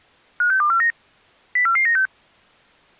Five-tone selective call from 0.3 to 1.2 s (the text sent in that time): 56249